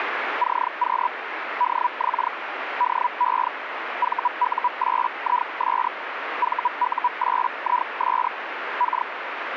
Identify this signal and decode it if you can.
Hellschreiber (Feld-Hell, 122.5 baud), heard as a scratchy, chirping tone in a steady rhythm, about 980 Hz, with radio static. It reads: CQ DX DE VU8IS VU8IS K